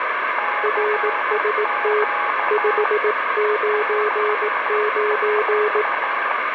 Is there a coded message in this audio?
Yes: Morse code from 0.3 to 6.4 s, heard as two keyed tones, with radio static and room echo. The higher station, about 13 wpm, 830 Hz: CQ CQ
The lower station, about 18 wpm, 420 Hz: RST 599